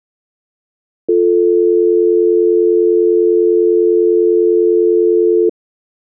Telephone call progress tone (North American or UK plan), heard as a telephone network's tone, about 350, 440 Hz. Dial tone.